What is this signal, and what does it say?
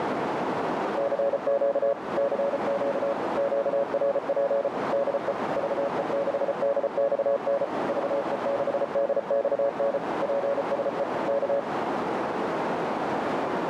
Morse code, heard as a keyed tone, machine-sent, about 34 wpm, 560 Hz, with heavy radio static and a narrow filter. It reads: CQ CQ QRP DE VE6DXN VE6DXN PSE K